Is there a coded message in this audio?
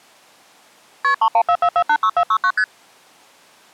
Yes: multi-frequency trunk signalling (R1, as on North American trunks) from 1.0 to 2.6 s, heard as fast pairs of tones, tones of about 70 ms. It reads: KP 3144486469 ST